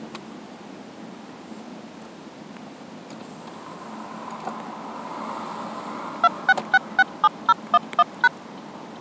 DTMF, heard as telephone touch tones, dialled by machine, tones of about 40 ms, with the noise inside a car. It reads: 26667011#